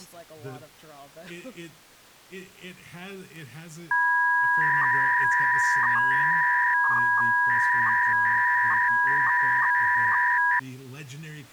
300-baud modem data (V.21 tones), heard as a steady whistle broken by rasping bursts, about 300 baud, 200 Hz shift, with speech in English.